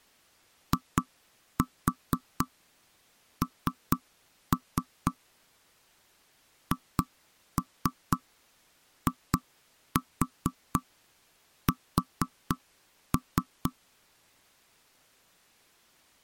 Tap code, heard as knocks on wood, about 4 knocks a second. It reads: IN HIS